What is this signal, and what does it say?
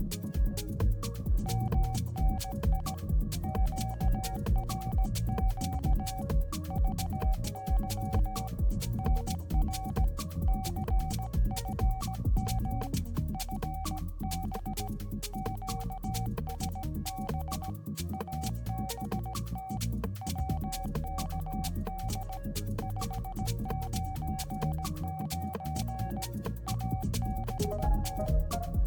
Morse code, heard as a keyed tone, hand-sent with a paddle, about 17 wpm, 760 Hz. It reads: MNI QRQ VY NR CFM FB QSB ABT WKD 599 ABT